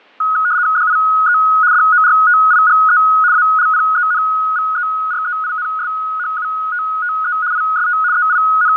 RTTY (75 baud, 170 Hz shift), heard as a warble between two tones, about 1360 Hz centre, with fading. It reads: DIE DORTIGE ALPENVEREINSHUTTE IST …